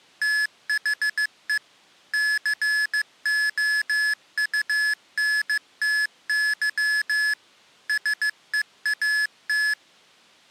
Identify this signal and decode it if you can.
Morse code, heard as electronic beeps, machine-sent, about 15 wpm, 1700 Hz. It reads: THE COUNTY SEAT